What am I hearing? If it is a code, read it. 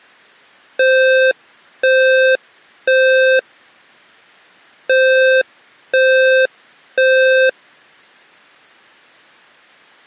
Alarm pattern, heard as an alarm's beeps, played twice, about 520 Hz. Temporal three. Smoke or fire, evacuate.